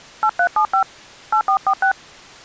DTMF, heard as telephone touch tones, dialled by hand, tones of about 80 ms. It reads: 8375 8446